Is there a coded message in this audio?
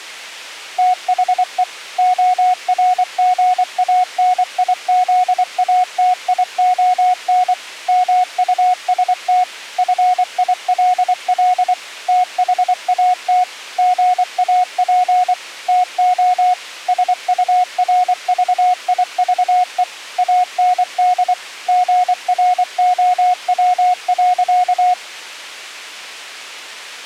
Yes: Morse code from 0.7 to 25.0 s, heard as a keyed tone, machine-sent, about 24 wpm, 730 Hz. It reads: THE ORGANIZATION MUST FILL THAT GAP TO SURVIVE AND GROW.